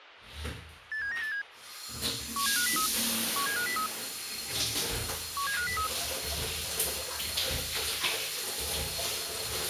Five-tone selective call (CCIR), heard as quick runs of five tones, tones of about 100 ms, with a squelch burst at the end and the noise of a restroom. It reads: 87987 17503 17503 17503